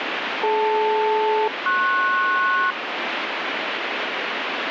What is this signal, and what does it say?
Aircraft SELCAL, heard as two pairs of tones, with radio static. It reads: DL-PS